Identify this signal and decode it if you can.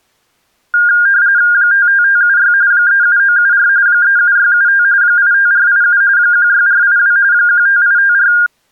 RTTY (45.45 baud, 170 Hz shift), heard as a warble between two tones, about 1500 Hz centre. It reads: 55576 37974 37675 85487 16482 15854